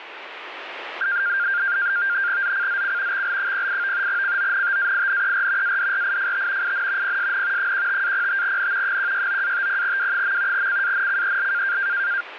NAVTEX (SITOR-B), 100 baud, 170 Hz shift, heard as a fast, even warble, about 1500 Hz centre, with radio static. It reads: ZCZC XL08 CONTAINER ADRIFT IN PSN 15-05N 169-50W. CANCEL